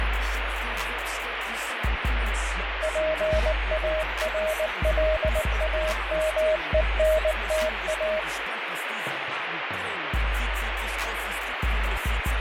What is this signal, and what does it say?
Morse code, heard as a keyed tone, machine-sent, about 19 wpm, 630 Hz, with radio static and fading. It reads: PARLAMENTA